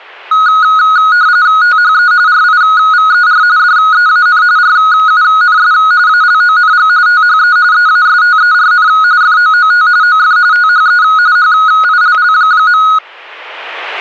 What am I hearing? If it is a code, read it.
RTTY (45.45 baud, 170 Hz shift), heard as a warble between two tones, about 1360 Hz centre, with static crashes. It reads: THE RIVER DEAN RUNS ALONG THE EASTERN FOOT OF THE HILL.